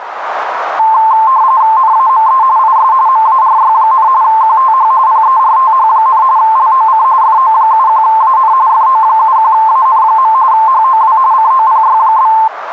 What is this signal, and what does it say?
RTTY (45.45 baud, 170 Hz shift), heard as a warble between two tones, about 970 Hz centre, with radio static and a narrow filter. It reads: NAME IS MARY, QTH PERTH, LOC FO71AN FO71AN. HOW COPY?